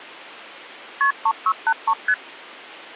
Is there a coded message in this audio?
Yes: multi-frequency trunk signalling (R1, as on North American trunks) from 1.0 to 2.1 s, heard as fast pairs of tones, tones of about 60 ms. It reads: KP 3683 ST